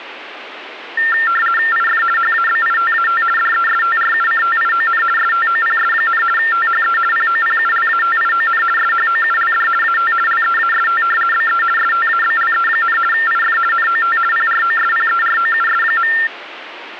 RTTY (50 baud, 450 Hz shift), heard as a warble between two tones, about 1600 Hz centre, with radio static. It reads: IF HABITAT DESTRUCTION STOPS, THE POPULATION SHOULD AT LEAST BE STABLE, IF NOT PROSPEROUS.